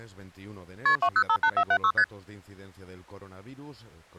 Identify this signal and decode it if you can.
Multi-frequency trunk signalling (R1, as on North American trunks), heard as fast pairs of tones, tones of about 70 ms. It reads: KP 2058476 ST